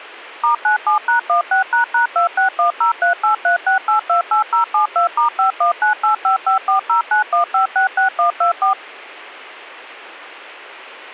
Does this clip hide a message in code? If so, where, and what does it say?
Yes: DTMF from 0.4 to 8.7 s, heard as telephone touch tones, dialled by machine, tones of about 120 ms. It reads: *97#16##26103836828072*5198554091566124